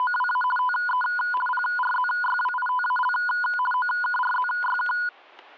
RTTY (50 baud, 450 Hz shift), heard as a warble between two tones, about 1230 Hz centre, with static crashes. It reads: … TE PRZYWITAL OKRZYK